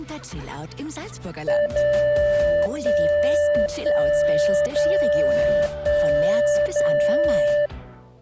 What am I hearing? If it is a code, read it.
Radio time signal (DCF77), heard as a tone whose level steps once a second, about 590 Hz. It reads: 0 1 1 0 1 0